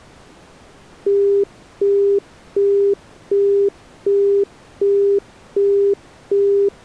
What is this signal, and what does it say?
Telephone call progress tone (as in the UK, Australia and similar networks), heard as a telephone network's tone, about 400 Hz, 0.375 s on and 0.375 s off. Busy tone.